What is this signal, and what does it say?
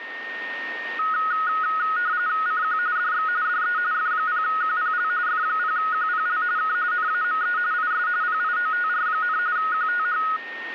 RTTY (45.45 baud, 170 Hz shift), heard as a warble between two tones, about 1360 Hz centre, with a steady whistle near 1840 Hz. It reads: CQ DX DE F0QPL F0QPL K NAME IS PIOTR, QTH